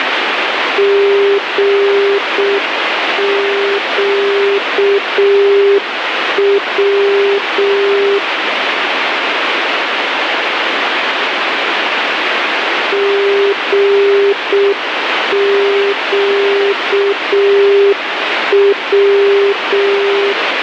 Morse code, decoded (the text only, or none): GQW GQW